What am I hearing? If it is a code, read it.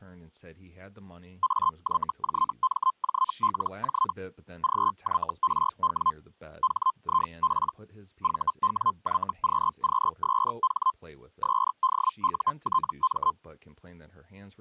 Hellschreiber (Feld-Hell, 122.5 baud), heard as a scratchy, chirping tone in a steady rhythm, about 1040 Hz, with speech in English. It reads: AYJMJLJ GYRW HIP VWYQQSH SDUTM